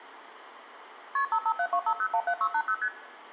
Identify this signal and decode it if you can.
Multi-frequency trunk signalling (R1, as on North American trunks), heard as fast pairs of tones, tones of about 70 ms, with room echo. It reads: KP 55725017680 ST